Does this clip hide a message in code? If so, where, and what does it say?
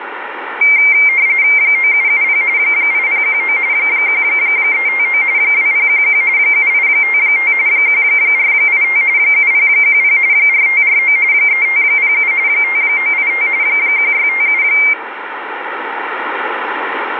Yes: RTTY (45.45 baud, 170 Hz shift) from 0.6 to 14.9 s, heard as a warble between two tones, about 2200 Hz centre, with radio static. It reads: 9770 8019 1359 2011 7855 1485 7010 4549 3507 5985 1657